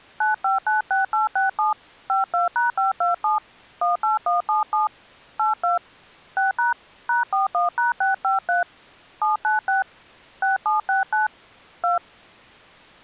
DTMF, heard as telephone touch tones, dialled by hand, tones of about 140 ms. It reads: 9596867 52#527 18177 82 6# #41#653 796 6769 2